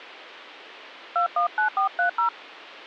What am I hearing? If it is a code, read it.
DTMF, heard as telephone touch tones, dialled by hand, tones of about 110 ms. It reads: 219430